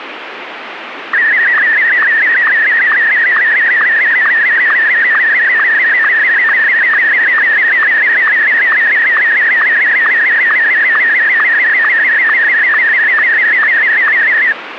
SSTV (slow-scan television), Martin M1, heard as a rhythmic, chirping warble, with radio static.